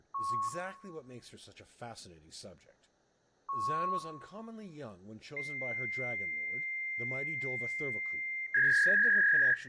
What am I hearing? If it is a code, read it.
Fax machine handshake, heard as a beep, a long tone and a warble, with room echo and speech in English.